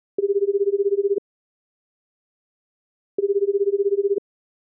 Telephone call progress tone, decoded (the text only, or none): ringback tone